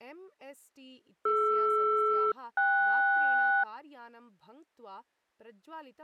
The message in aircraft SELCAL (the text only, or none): DR-KS